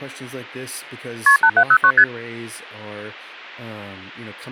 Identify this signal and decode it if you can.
Multi-frequency trunk signalling (R1, as on North American trunks), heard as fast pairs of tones, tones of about 70 ms, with speech in English. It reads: KP 8709 ST